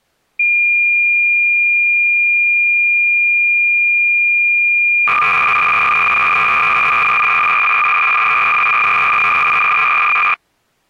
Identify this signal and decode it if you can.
Cassette data (Kansas City type), 300 baud, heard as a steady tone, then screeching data.